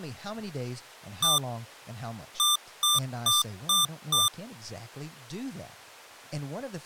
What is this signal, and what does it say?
Beep code, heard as beeps from a small speaker, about 1190 Hz, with speech in English. 1-5.